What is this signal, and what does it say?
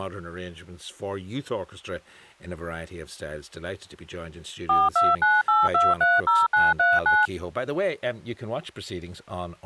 DTMF, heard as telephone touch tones, dialled by machine, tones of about 200 ms, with speech in English. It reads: 4298230939